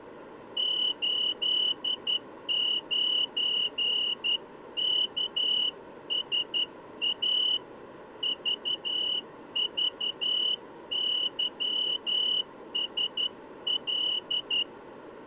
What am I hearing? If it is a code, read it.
Morse code, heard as a whistle, hand-sent with a straight key, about 11 wpm. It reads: 89KSA VVYSL